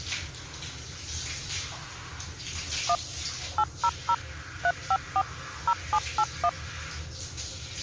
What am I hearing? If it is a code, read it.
DTMF, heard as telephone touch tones, dialled by machine, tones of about 60 ms, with the noise of a restroom. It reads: 1 800 354 0781